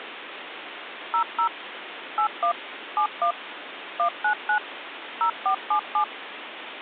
DTMF, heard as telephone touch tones, dialled by machine, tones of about 90 ms, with phone line noise. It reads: 00 81 71 199 0477